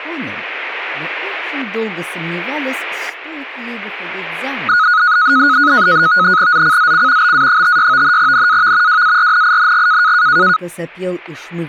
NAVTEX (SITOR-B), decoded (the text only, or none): ZCZC BA56 NAV WARNING